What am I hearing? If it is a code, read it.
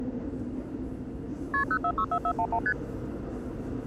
Multi-frequency trunk signalling (R1, as on North American trunks), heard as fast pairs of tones, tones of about 70 ms, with the noise inside a subway train. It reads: KP 0464411 ST